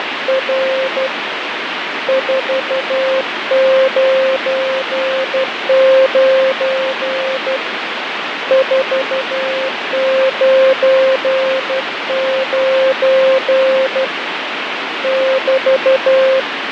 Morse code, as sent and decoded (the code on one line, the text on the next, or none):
… / ....- ----. ----. / ....- ----. ----. / -...-
… 499 499 <BT>